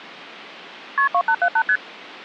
Multi-frequency trunk signalling (R1, as on North American trunks), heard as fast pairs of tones, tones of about 70 ms. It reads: KP 2878 ST